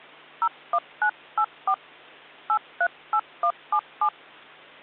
DTMF, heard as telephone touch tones, dialled by hand, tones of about 70 ms, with hum. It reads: 01984 838177